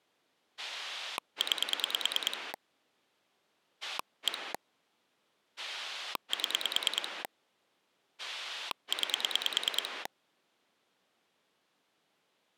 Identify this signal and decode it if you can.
Pulse dialling, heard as a rotary dial, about 9 pulses a second. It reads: 9 1 7 9